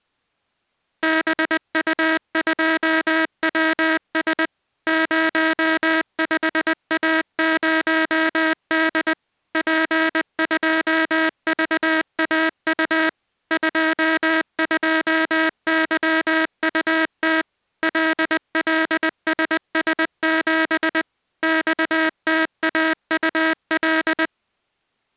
Morse code, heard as a buzzer, machine-sent, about 20 wpm. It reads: BU2WS 05A0D P2VAU 22YUT LLSS7 XTAUL